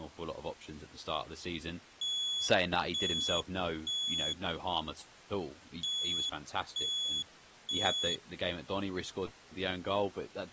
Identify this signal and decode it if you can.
Alarm pattern, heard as an alarm's beeps, played twice, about 3400 Hz, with speech in English. Temporal three. Smoke or fire, evacuate.